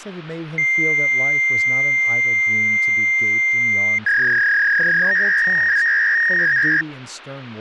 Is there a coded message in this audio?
Yes: fax machine handshake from 0.6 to 6.8 s, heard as a long tone and a warble, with speech in English.